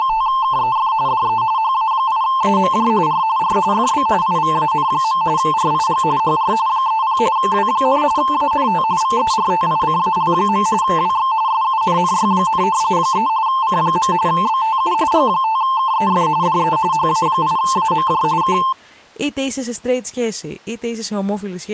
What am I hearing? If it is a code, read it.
RTTY (45.45 baud, 170 Hz shift), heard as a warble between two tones, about 970 Hz centre, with speech in Greek. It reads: … DE HA8AMJ R R FB IVAN. RIG HR 30 W, ANT VERTICAL. WX SUNNY, 3 C. BTU G5KEF DE HA8AMJ K